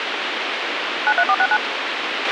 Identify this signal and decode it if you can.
DTMF, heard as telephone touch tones, dialled by machine, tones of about 60 ms, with radio hiss and a squelch burst at the end. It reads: 93469